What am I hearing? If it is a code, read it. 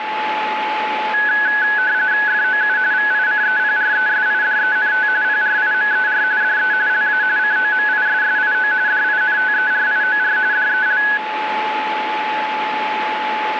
RTTY (45.45 baud, 170 Hz shift), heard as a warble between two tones, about 1600 Hz centre, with radio static and a steady whistle near 860 Hz. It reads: FOU VICEPRESIDENT PRIMER DE LA COMISSIO DINTERIOR DEL